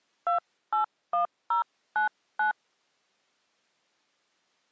DTMF, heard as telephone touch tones, dialled by hand, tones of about 120 ms. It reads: 281099